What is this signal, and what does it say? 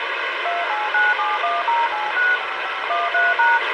DTMF, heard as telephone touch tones, dialled by machine, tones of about 190 ms, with radio hiss and a squelch burst at the end. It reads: 289710865513#